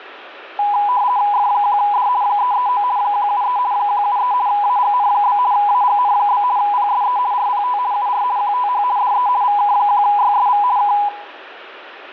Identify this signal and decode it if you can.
RTTY (50 baud, 170 Hz shift), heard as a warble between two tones, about 910 Hz centre, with radio static. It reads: F1D 339 173 173 AGN? AGN? PSE RPT UR QTH DE VK1YSV K